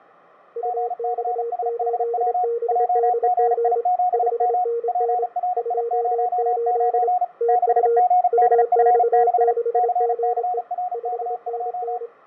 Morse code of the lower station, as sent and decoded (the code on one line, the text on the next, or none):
..- -..- ---.. -... -.. --. / ..... -. -. / ..--- ---.. / - ..- / ..- -..- -.... --. . / ..... -. -.
UX8BDG 5NN 28 TU UX6GE 5NN